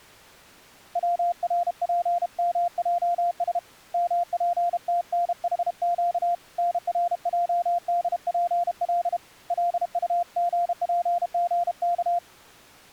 Morse code (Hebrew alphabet), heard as a keyed tone, hand-sent with a paddle, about 32 wpm, 700 Hz. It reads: צרפמעש מפתנחק נרעדפל לטגפגך